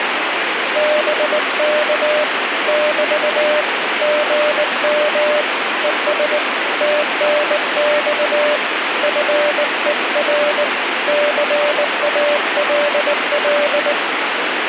Morse code, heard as a keyed tone, hand-sent with a bug key, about 19 wpm, 600 Hz, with radio static. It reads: BK <BT> GM ES TNX FER CALL